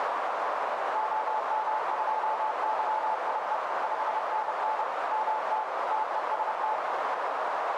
Morse code, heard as a keyed tone, machine-sent, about 30 wpm, 870 Hz, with heavy radio static and a narrow filter. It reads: OM2YIE 5NN MT TEST